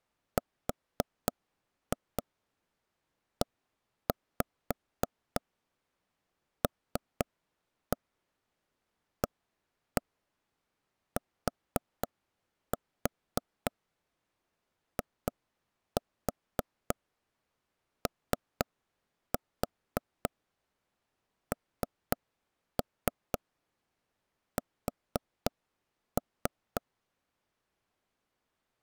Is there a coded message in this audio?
Yes: tap code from 0.4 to 26.8 s, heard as taps on a table, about 3 knocks a second. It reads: RELATIONS